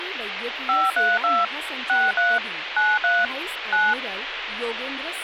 DTMF, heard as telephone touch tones, dialled by machine, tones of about 210 ms, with phone line noise and speech in Marathi. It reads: 532 63 93 9